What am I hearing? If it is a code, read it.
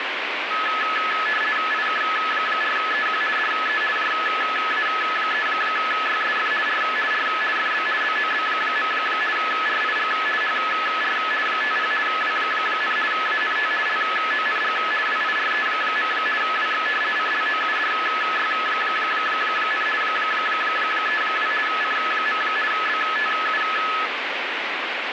RTTY (50 baud, 450 Hz shift), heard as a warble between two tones, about 1500 Hz centre, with radio static. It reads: IK4EQ DE JA3YSF R R FB BOB. RIG HR 50 W, ANT LONG WIRE. WX CLOUDY, 32 C. BTU